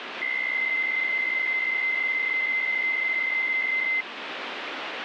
PSK63 (62.5 baud), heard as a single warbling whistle, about 2050 Hz, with radio static.